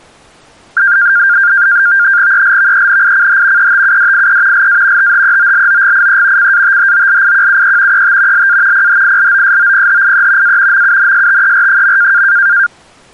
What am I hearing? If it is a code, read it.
NAVTEX (SITOR-B), 100 baud, 170 Hz shift, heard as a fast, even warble, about 1500 Hz centre. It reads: ELVENICH ETUDIE LA THEOLOGIE CATHOLIQUE ET LA PHILOSOPHIE A MUNSTER.